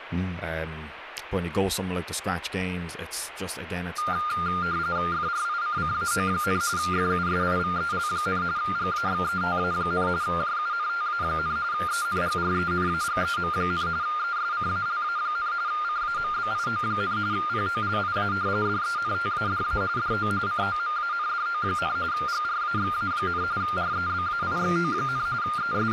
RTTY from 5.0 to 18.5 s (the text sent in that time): FRICCAO, FUSIVEL, GAXETA, JUNTA, ENGRENAGEM, ESCALA, CAMBIO, POLIA